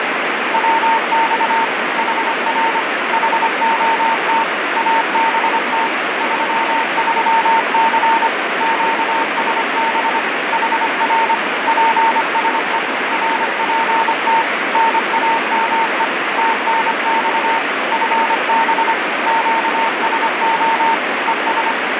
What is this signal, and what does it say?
Morse code, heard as a keyed tone, machine-sent, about 25 wpm, 910 Hz, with heavy radio static. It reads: WX HR HOT ABT 33C QSB HR PSE RPT NAME TNX FB QSO ES